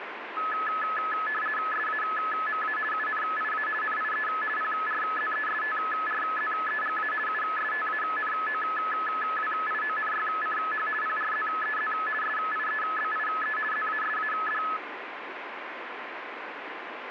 RTTY (50 baud, 450 Hz shift), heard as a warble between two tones, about 1500 Hz centre, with radio static. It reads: SAMA UNIA NIE PRZESTRZEGA USTANOWIONYCH PRZEZ SIEBIE ZASAD